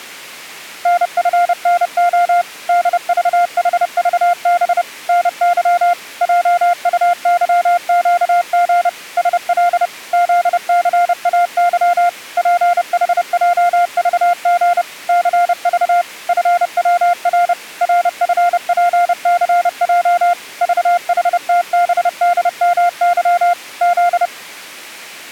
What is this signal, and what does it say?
Morse code, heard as a keyed tone, machine-sent, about 30 wpm, 700 Hz. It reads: NFNO DVHVB NY JUYQG SL ZCAY PHJVG CV FWR RFPCJ VHTBDMY Z